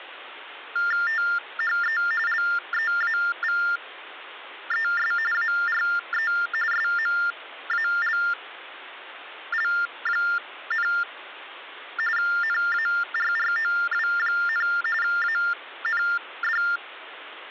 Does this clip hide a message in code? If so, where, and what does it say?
Yes: TTY/TDD text telephone tones (45.45 baud Baudot) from 0.8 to 16.8 s, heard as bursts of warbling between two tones, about 400 Hz shift, 1600 Hz centre, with phone line noise. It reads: THE LEAVES ARE SMALL, NARROW, AND